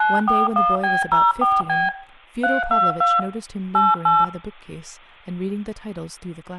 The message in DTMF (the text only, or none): 941B04B 322 88